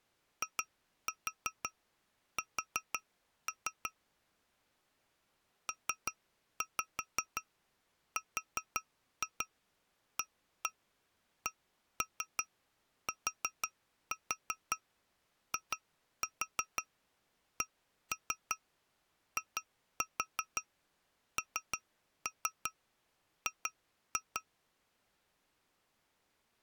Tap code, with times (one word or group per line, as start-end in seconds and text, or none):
0.4-3.9 IS
5.7-24.4 PRACTICING